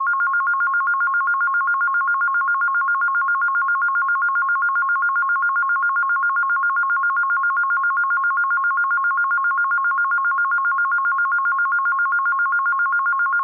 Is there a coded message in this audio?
No, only a tone that alternates evenly between two pitches.